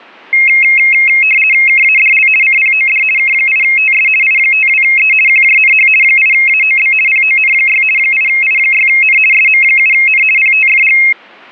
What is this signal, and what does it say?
RTTY (50 baud, 450 Hz shift), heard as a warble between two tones, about 2350 Hz centre. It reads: KADL CPOD K8TS I52E QJNH 8AOB PON6 8I6N SM7N PTFG